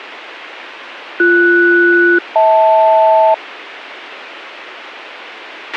Aircraft SELCAL, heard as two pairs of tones, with a squelch burst at the end. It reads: BS-HL